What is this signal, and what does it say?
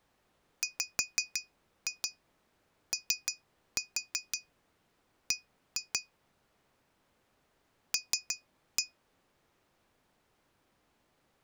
Tap code, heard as taps on glass, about 6 knocks a second. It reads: WOB L